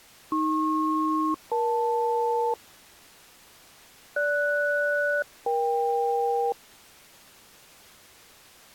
Aircraft SELCAL, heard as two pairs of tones. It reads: AP-EL GS-EK